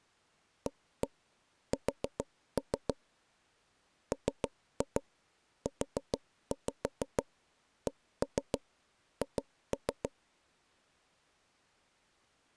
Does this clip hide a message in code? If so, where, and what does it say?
Yes: tap code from 0.7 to 10.1 s, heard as taps on a table, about 6 knocks a second. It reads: AS MUCH